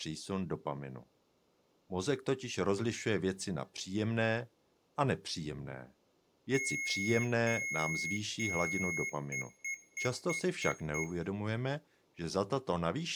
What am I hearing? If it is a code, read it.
Beep code, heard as beeps from a small speaker, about 2150 Hz, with room echo and speech in Czech. 3 long, 6 short.